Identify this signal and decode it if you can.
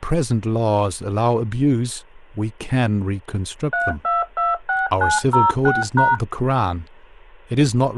DTMF, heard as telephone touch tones, dialled by machine, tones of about 180 ms, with speech in English. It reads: 3226906#